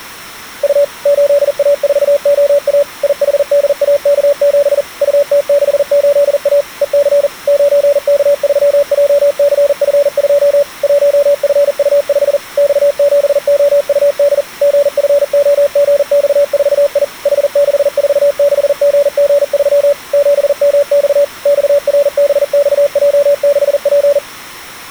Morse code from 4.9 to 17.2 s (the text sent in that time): UT68A EC 9K3JCF2 1FU5 X7OUD GFOGX4I